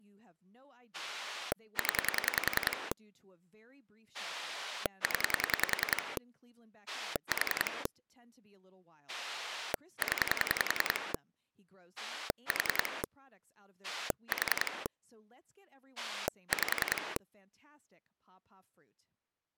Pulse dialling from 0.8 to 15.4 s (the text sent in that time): 0 0 4 0 4 4